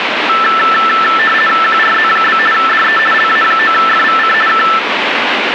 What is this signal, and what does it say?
RTTY (50 baud, 450 Hz shift), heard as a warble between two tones, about 1550 Hz centre, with radio static. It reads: QRZ? DE LA9FVC K